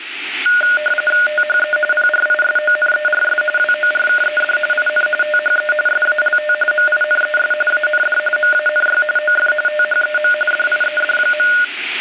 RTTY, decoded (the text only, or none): THE PRISONERS WORKED IN THE SALT MINES AND MANY OF THEM DIED.